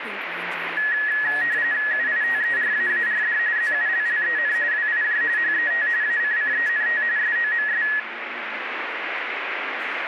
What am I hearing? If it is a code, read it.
RTTY (45.45 baud, 170 Hz shift), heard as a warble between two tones, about 1800 Hz centre, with radio static. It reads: UITERAARD ZULLEN WIJ HET ACCENT SOMS